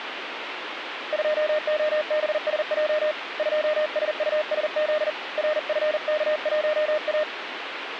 Morse code, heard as a keyed tone, hand-sent with a paddle, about 40 wpm, 610 Hz, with radio static. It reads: 2OBSJ 2SUSZ RFK1A